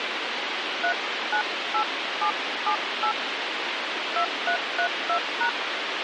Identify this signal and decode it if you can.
DTMF, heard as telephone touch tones, dialled by hand, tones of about 90 ms, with radio hiss. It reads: 398778 2332#